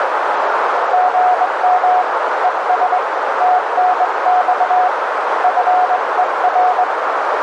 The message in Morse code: GM ES TNX FER

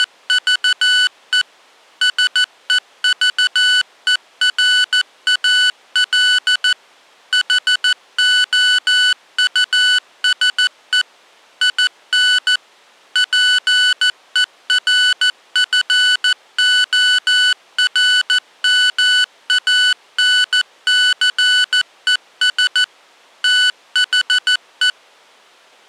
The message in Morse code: … SEVERAL HOUSE IN PERFORMANCES THE

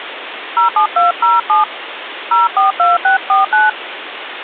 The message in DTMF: 07207 042649

